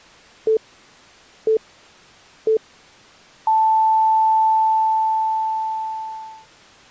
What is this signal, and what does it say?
Radio time signal (three low pips and a long one an octave up, as on NHK), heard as pips.